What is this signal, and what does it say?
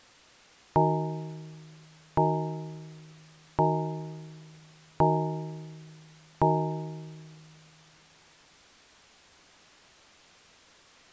Clock strike, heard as a bell. 5. Five o'clock.